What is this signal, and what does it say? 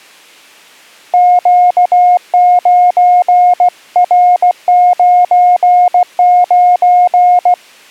Morse code, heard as a keyed tone, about 16 wpm, 720 Hz. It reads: Q9R99